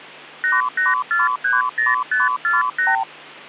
Multi-frequency trunk signalling (R2, with the far end's replies), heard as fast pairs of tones, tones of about 170 ms, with hum. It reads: 88430548